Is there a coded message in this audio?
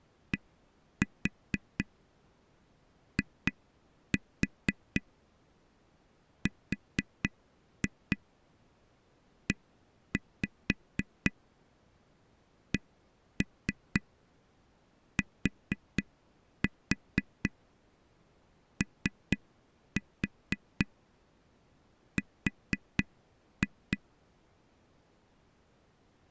Yes: tap code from 0.3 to 24.0 s, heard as taps on a table, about 4 knocks a second. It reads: DIRECTOR